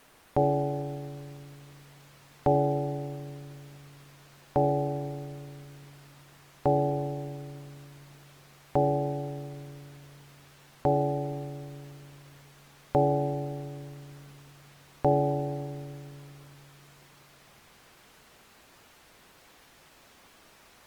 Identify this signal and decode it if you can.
Clock strike, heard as a bell. 8. Eight o'clock.